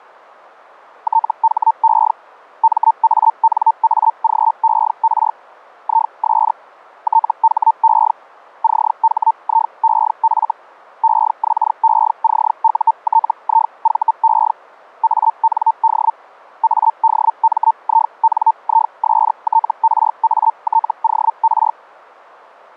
Hellschreiber (Feld-Hell, 122.5 baud), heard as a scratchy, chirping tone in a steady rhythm, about 900 Hz. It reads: THE MANAGER IS THE CHIEF EXECUTIVE AND ADMINISTRATOR